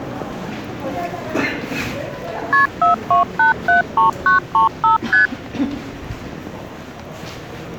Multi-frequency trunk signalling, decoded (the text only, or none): KP 42873935 ST